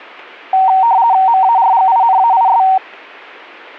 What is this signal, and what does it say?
RTTY (50 baud, 170 Hz shift), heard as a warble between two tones, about 840 Hz centre. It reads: MARGINAIS